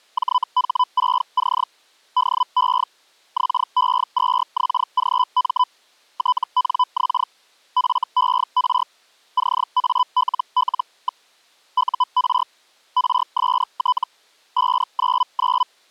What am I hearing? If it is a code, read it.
Hellschreiber (Feld-Hell, 122.5 baud), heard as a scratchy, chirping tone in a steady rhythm, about 1000 Hz. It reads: JH6C DE XE2XGM TNX FER CALL. UR RST 599